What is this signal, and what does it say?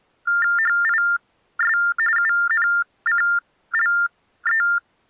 TTY/TDD text telephone tones (45.45 baud Baudot), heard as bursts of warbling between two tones, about 400 Hz shift, 1600 Hz centre. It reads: HIS UNCLE